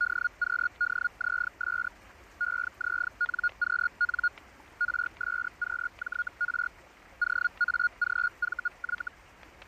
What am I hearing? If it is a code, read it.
Hellschreiber (Feld-Hell, 122.5 baud), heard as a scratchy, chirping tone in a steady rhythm, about 1440 Hz, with static crashes and the noise of a park. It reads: DQDZS EZNQN RSQJR OAGVY